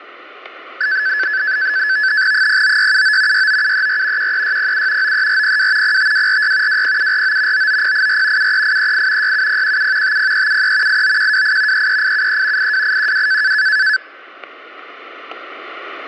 NAVTEX (SITOR-B), 100 baud, 170 Hz shift, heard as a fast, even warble, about 1600 Hz centre, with static crashes. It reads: 09679 69734 13607 93402 05246 20749 99084 73838 67017 50373 89128 33873 82812